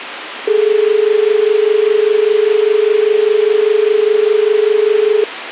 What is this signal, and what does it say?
Telephone call progress tone (as in Australia), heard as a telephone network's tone, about 430 Hz, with phone line noise. Dial tone.